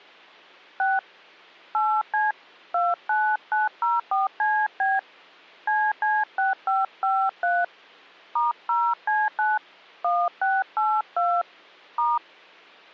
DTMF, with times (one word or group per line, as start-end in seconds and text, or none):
0.8-1.0 6
1.7-2.3 8C
2.7-5.0 29904CB
5.7-7.6 CC6553
8.4-9.6 *0C9
10.0-11.4 1682
12.0-12.2 *